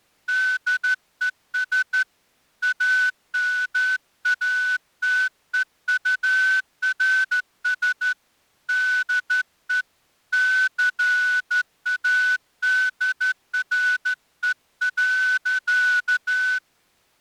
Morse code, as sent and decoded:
-.. . ... / .- -- .- - . ..- .-. ... / -.. . / -.-. .- -.. .-. . .-.-.-
DES AMATEURS DE CADRE.

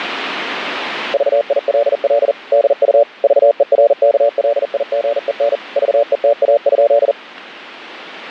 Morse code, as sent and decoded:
...- .. .-.. .-.. / -.. ..- / ...- . .-. -.- .-.. .. --. . -. / ...- . - .- ..--..
VILL DU VERKLIGEN VETA?

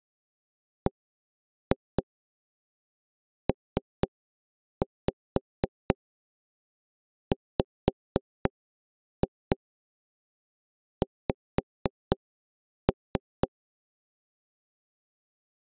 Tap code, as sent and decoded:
1-2 3-5 5-2 5-3
BPWX

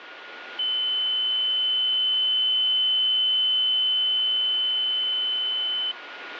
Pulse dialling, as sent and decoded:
none

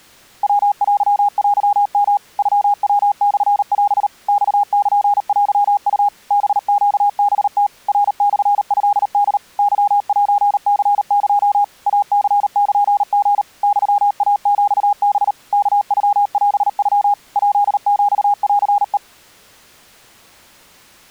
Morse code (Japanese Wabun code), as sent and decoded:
.-- .-.-- .-.-- -- / ..-- .-- -..-. .-... / -..- -.--. .-.-- ..- / -... --.- -... - / .-. -..-. ..-.. -.. / -.-- .---. -.-. -.--- / .- -.-. -.--. --. / -..-- .- --..- -... / -.- ..-- .-... ..-- / .--.. --..- .-.-. .
ヤテテヨ ノヤモオ マルテウ ハネハム ナモトホ ケセニエ イニルリ ユイヒハ ワノオノ ヱヒンヘ

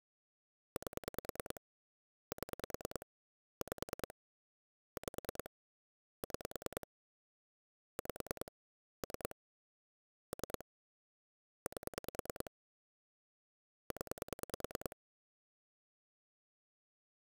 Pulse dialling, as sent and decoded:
8 / 7 / 5 / 5 / 6 / 5 / 3 / 3 / 8 / 10
8 7 5 5 6 5 3 3 8 0

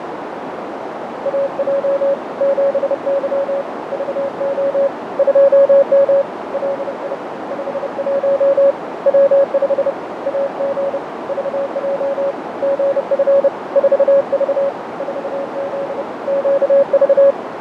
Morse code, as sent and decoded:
.- .--- / --... -.-- / ...- --- / ..--- -- / .-.. .. / ..... .---- / .-- ..... / .- --. / ...- .--- / --. ..-. / ....- ...- / ....- --.. / --.- ...-
AJ 7Y VO 2M LI 51 W5 AG VJ GF 4V 4Z QV

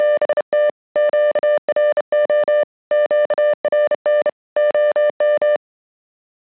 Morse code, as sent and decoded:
… / --.- .-. --- / --.- .-. -. / --- --
… QRO QRN OM

